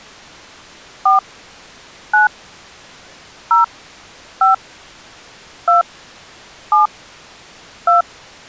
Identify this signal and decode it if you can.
DTMF, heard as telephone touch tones, dialled by hand, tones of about 140 ms. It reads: 4 9 0 5 2 7 2